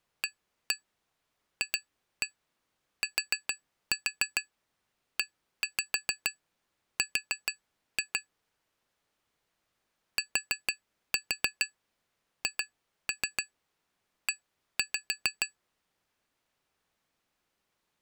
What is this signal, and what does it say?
Tap code, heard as taps on glass, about 6 knocks a second. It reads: AFTER THE